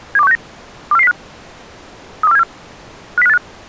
Five-tone selective call (EEA), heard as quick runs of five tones, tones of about 40 ms. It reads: 72169 24405 32474 50585